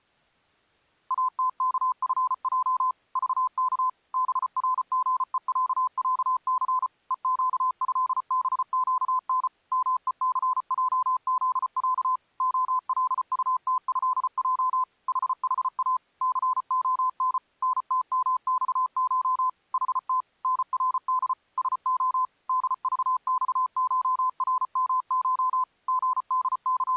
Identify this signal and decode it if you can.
Morse code (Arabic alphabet), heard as a keyed tone, machine-sent, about 34 wpm, 1020 Hz. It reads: اتكفج ضك برغءععث ءقهبقن مءثجذع خلطتهج ححا ثخن نتمصش حت نرد سخ دضصشرمش …